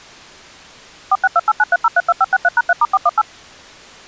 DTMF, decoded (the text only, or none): 462893032563#3*418